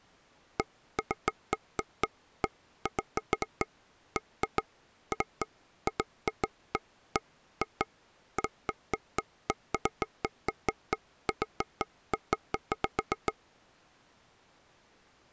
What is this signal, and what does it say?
Irregular taps on a table. There is no code.